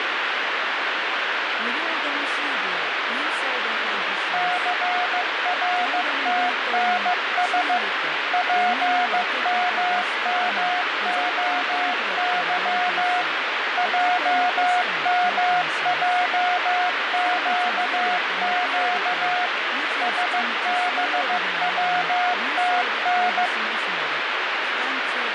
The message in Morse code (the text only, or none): CRTNS PMMOY JMJQQ SBWTN